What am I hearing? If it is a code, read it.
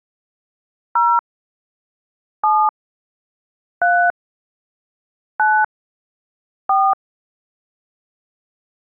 DTMF, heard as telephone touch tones, dialled by hand, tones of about 270 ms. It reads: 0 7 3 9 4